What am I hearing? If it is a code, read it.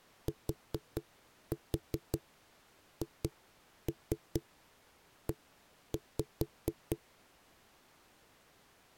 Tap code, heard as knocks on a wall, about 4 knocks a second. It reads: THE